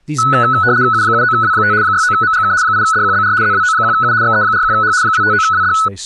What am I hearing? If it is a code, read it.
RTTY (75 baud, 170 Hz shift), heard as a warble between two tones, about 1390 Hz centre, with speech in English. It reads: U79W5 69MGK 8DQBR ZWO1U XE41H 259WD